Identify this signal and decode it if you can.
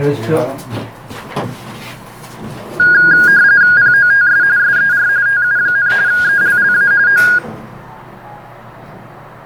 RTTY (45.45 baud, 170 Hz shift), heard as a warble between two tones, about 1550 Hz centre, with the noise inside a lift. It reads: POTS SER TU, ELLA O